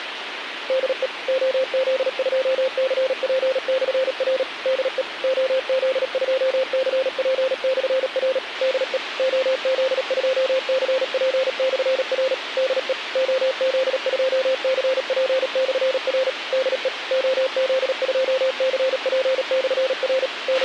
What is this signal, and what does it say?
Morse code, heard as a keyed tone, machine-sent, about 37 wpm, 520 Hz, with radio hiss and a squelch burst at the end. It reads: DE OZ2CP/R DE OZ2CP/R DE OZ2CP/R DE OZ2CP/R DE OZ2CP/R …